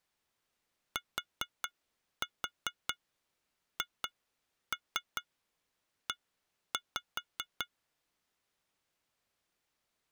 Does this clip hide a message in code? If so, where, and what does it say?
Yes: tap code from 1.0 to 7.7 s, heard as taps on glass, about 4 knocks a second. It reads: THE